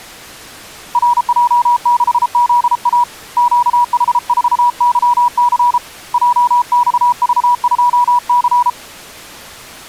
Morse code, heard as a keyed tone, hand-sent with a paddle, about 33 wpm, 970 Hz. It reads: RJ6ZA QH4YC JXV2C